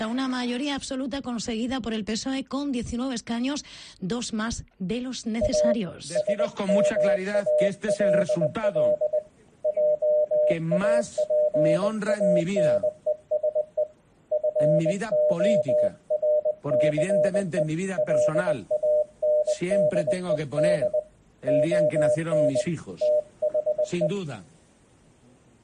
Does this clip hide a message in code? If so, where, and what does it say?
Yes: Morse code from 5.4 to 24.1 s, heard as a keyed tone, hand-sent with a bug key, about 20 wpm, 600 Hz. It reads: A SMALL JAPANESE FORCE LANDED ON THE